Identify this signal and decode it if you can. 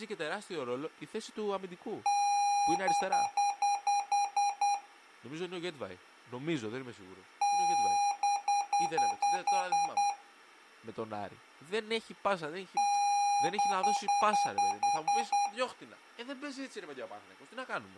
Beep code, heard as beeps from a small speaker, played three times, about 810 Hz, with speech in Greek. 1 long, 8 short. In AMI BIOS tables: display or retrace test failure.